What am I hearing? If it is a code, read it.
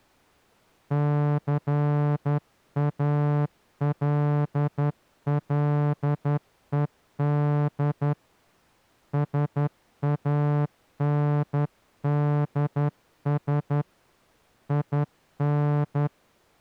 Morse code, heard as a horn, hand-sent with a straight key, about 11 wpm. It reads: CALLED SANDS IN